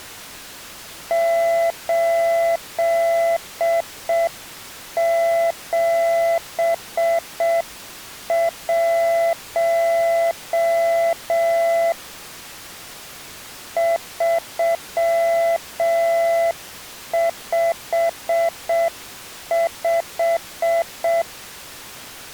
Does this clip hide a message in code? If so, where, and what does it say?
Yes: Morse code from 1.0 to 21.3 s, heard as a keyed tone, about 6 wpm, 670 Hz. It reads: 871 355